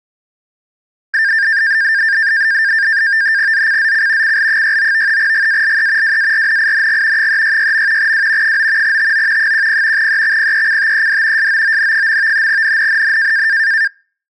NAVTEX (SITOR-B), 100 baud, 170 Hz shift, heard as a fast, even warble, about 1700 Hz centre. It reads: ZCZC CL69 GALE WARNING 366. W 9 TO 10 EXPECTED SOON. NNNN